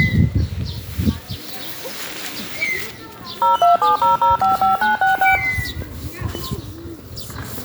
DTMF, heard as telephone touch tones, dialled by machine, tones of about 140 ms, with the noise of a residential street. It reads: 0270055966